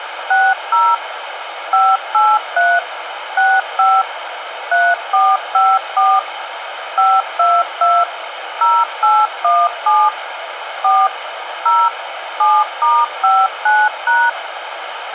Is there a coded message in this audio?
Yes: DTMF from 0.3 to 14.3 s, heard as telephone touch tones, dialled by machine, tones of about 230 ms, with radio hiss. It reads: 60 583 65 3454 522 0817 4 0 7*59#